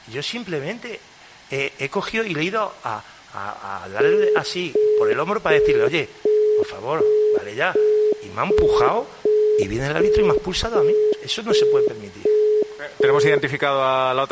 Telephone call progress tone (as in the UK, Australia and similar networks), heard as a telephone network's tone, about 420 Hz, 0.375 s on and 0.375 s off. Busy tone.